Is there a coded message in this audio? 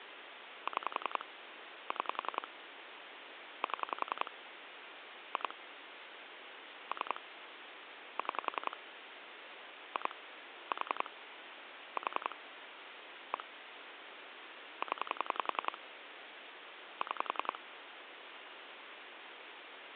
Yes: pulse dialling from 0.7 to 17.6 s, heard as clicks on a phone line, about 10 pulses a second, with phone line noise. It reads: 6 6 7 2 3 6 2 4 4 1 0 6